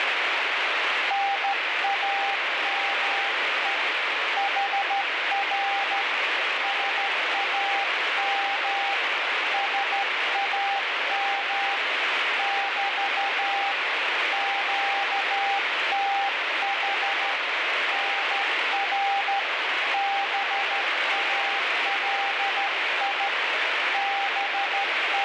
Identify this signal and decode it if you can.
Morse code, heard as a keyed tone, hand-sent with a straight key, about 13 wpm, 800 Hz, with heavy radio static. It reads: NAME HR SAM SAM <BT> QTH NR BALI …